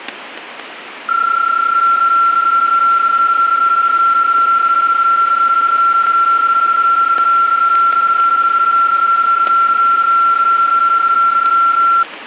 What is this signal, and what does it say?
PSK31 (31.25 baud), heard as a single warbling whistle, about 1360 Hz, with static crashes.